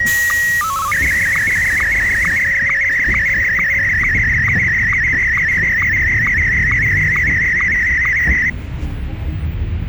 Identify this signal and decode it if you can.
SSTV (slow-scan television), Martin M1, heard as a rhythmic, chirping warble, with the noise inside a bus.